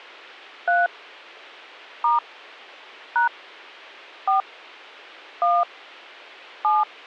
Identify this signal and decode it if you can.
DTMF, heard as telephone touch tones, dialled by hand, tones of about 160 ms. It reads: 3 * # 4 1 7